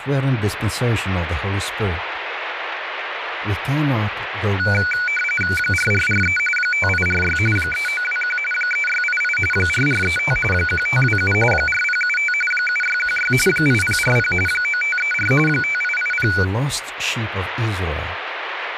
RTTY (45.45 baud, 850 Hz shift), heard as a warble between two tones, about 1900 Hz centre, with radio static and speech in English. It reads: 4443 5846 3921 3688 4435 1527 4075 7616 8040 9534 5880